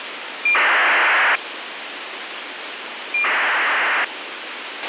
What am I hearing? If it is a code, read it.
ACARS aircraft data, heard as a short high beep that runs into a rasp, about 2400 baud, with radio hiss and a squelch burst at the end.